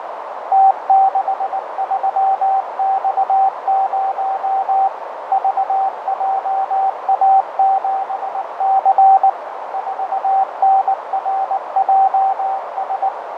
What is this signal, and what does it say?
Morse code, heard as a keyed tone, machine-sent, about 19 wpm, 770 Hz, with heavy radio static, fading and a narrow filter. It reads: T63X0 VJA7C 4NRJS